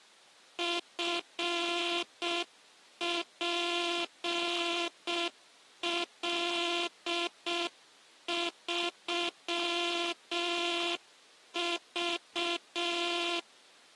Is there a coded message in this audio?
Yes: Morse code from 0.5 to 13.5 s, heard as a buzzer, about 6 wpm. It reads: FPL3V